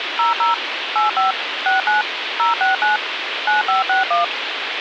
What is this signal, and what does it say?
DTMF, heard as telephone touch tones, dialled by machine, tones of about 140 ms, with phone line noise. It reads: 00 85 69 069 9561